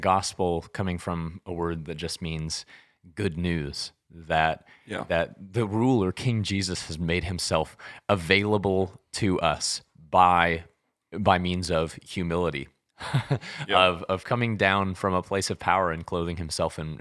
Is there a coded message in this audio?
No, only speech in English.